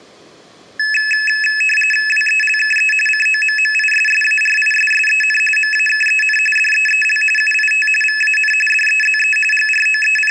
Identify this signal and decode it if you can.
RTTY (45.45 baud, 850 Hz shift), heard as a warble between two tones, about 2150 Hz centre, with room echo. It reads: WELKE COMMISSARISSEN MAKEN DEEL UIT VAN DEZE …